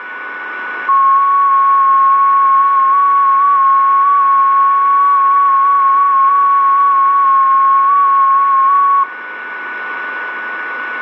FT8 (one signal), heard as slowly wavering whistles, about 6.25 baud, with radio static, a steady whistle near 1480 Hz and room echo.